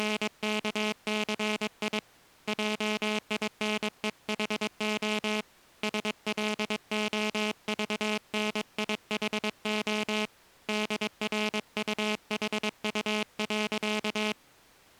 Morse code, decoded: … JINEHO SLOVNIHO DRUHU.

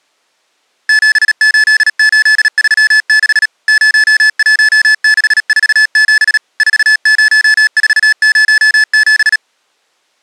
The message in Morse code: 78836 01647 40407

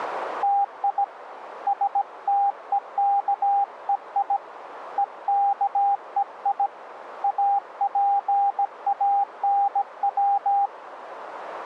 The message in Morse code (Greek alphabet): ΤΙ ΣΤΕΚΕΙ ΕΚΕΙ ΑΠΑΝΩ

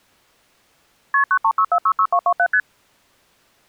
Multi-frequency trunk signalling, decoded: KP 936466227 ST

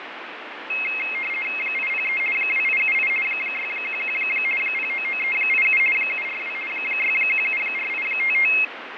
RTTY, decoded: 803 2878 611 099387 742 6174855

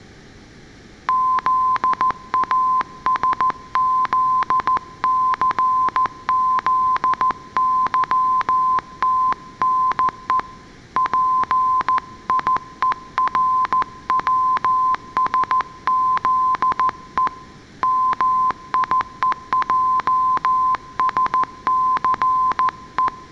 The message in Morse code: ZASZCZYTNE PIERWSZE MIEJSCE

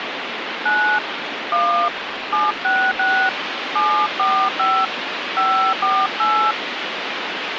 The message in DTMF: 9 1 766 745 548

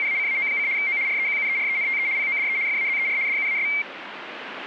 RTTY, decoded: … O REQUERENTE PODE FAZER DUAS

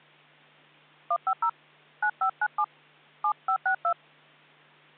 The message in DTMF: 150 9597 7562

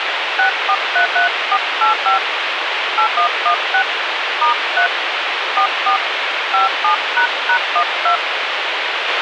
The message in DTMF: 6433485 8116 *3 44 57##12

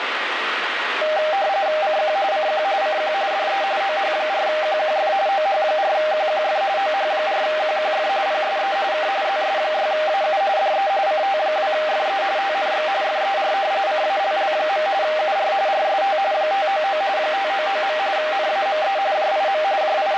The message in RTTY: CQ CQ CQ DE OH4QQF OH4QQF OH4QQF PSE K ZS6AU DE CT2FE TNX FER CALL. UR RST 599 599. NAME JIM …

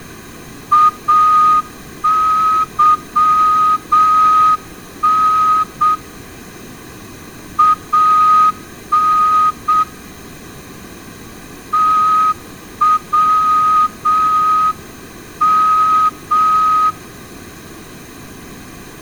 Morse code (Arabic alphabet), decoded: اظن ان توم

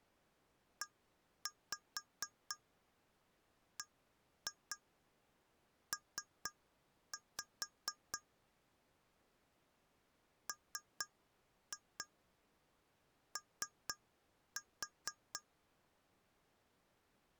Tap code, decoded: EBP MO

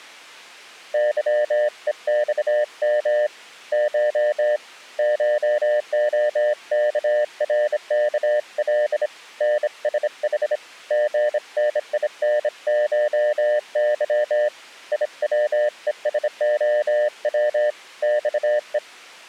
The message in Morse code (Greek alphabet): ΥΕΞΜ Χ ΧΟΚΡΚΛ ΝΣΗ ΓΝΙΝΧΥ ΙΩΕΣΟΩ ΞΕ

